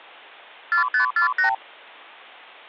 Multi-frequency trunk signalling (R2, with the far end's replies), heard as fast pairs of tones, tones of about 110 ms. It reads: 4548